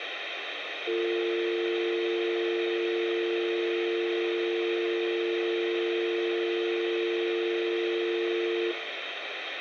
Telephone call progress tone (North American or UK plan), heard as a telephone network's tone, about 350, 450 Hz, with phone line noise and room echo. Dial tone.